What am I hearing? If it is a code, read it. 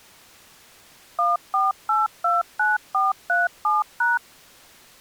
DTMF, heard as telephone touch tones, dialled by machine, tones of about 170 ms. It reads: 14829437#